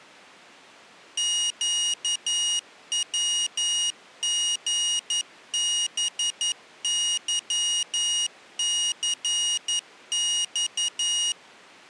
Morse code, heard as a high beeper, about 11 wpm, 2900 Hz. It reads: QWGBYCX